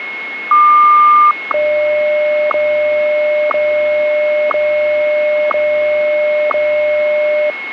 Radio time signal (WWVH, Hawaii), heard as ticks, one a second, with radio static and a steady whistle near 2170 Hz.